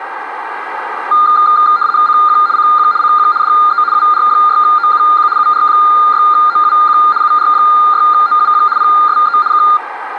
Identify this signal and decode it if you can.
RTTY (75 baud, 170 Hz shift), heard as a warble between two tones, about 1300 Hz centre, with radio static and a narrow filter. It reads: CQ CQ CQ DE UR6OUQ UR6OUQ UR6OUQ PSE K